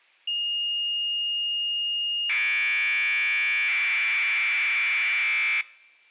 Commodore tape loading (standard loader), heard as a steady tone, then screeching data.